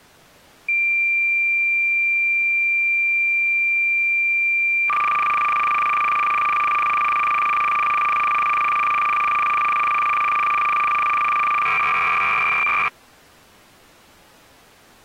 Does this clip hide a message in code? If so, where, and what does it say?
Yes: cassette data (Kansas City type), 300 baud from 0.7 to 12.9 s, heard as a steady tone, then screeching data.